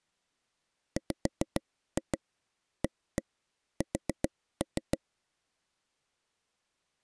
Tap code, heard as taps on a table, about 7 knocks a second. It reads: WAS